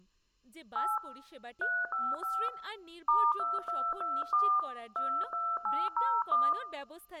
DTMF, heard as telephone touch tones, dialled by hand, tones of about 250 ms, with speech in Bangla. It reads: 8 355 *2224 22801